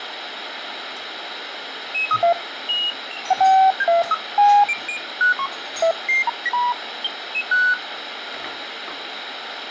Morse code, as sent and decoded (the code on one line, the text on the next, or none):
none